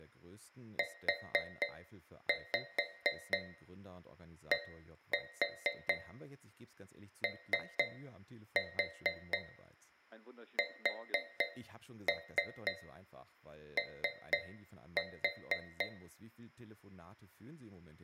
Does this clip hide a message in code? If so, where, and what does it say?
Yes: tap code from 0.8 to 16.0 s, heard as taps on a metal pipe, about 4 knocks a second, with room echo and speech in German. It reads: UDOSO